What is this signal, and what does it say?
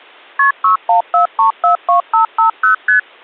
Multi-frequency trunk signalling (R1, as on North American trunks), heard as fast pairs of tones, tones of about 120 ms. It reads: KP 614342550 ST